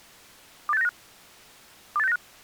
Five-tone selective call (EEA), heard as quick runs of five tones, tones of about 40 ms. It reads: 28695 28695